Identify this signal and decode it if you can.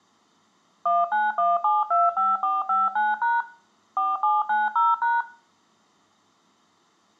DTMF, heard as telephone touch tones, dialled by machine, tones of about 190 ms, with room echo. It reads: 191725459# 4790#